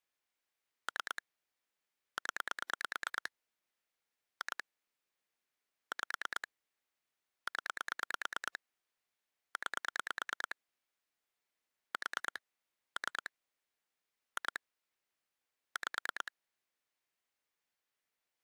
Pulse dialling, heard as clicks on a phone line, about 9 pulses a second. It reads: 3 0 2 5 0 9 4 3 2 5